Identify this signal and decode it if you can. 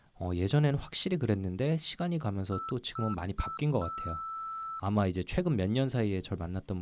Beep code, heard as beeps from a small speaker, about 1320 Hz, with speech in Korean. 3 short, 1 long.